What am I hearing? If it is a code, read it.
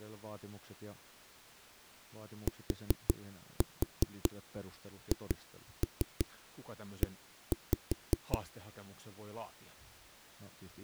Tap code, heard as knocks on a wall, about 5 knocks a second, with speech in Finnish. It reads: THE